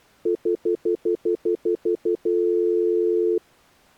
Telephone call progress tone (North American plan), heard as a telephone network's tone, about 350, 440 Hz, 0.1 s on and 0.1 s off. Stutter dial tone.